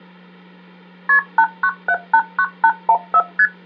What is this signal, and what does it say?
Multi-frequency trunk signalling (R1, as on North American trunks), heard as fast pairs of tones, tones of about 60 ms, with hum. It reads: KP 89789814 ST